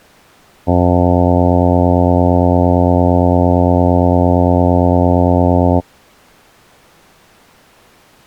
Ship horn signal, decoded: 1 long

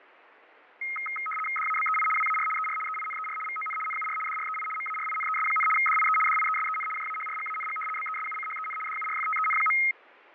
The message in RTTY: DABEI WAR ER EINER VON NUR DREI MARINES, DIE DIESEN JAHRGANG BESUCHEN DURFTEN.

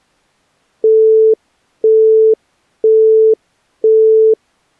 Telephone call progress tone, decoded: busy tone

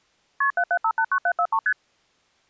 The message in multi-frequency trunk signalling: KP 77589743 ST

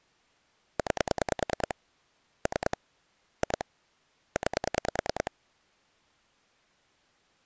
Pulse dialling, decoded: 9 3 2 9

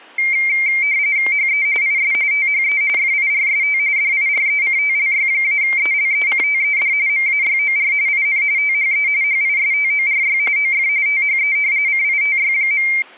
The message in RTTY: HE IS THE FIRST DIRECTLY-ELECTED MAYOR IN THE HISTORY OF THE CITY.

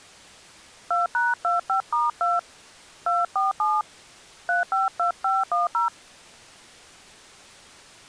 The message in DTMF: 2#25*2 247 352510

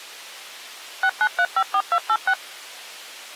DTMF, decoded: 69354286

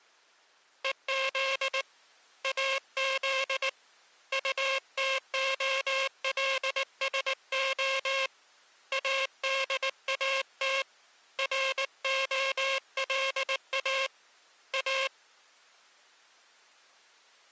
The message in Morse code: EZ AZ UTOLSO ADAT ROLA A

